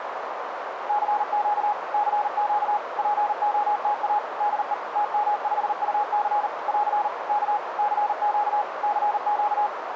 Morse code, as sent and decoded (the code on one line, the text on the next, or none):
-.-. --.- / -.-. --.- / .--. --- - .- / -.. . / - -- ..... ..- -.-. / .-.-. / -.- / -.-. --.- / -.-. --.-
CQ CQ POTA DE TM5UC <AR> K CQ CQ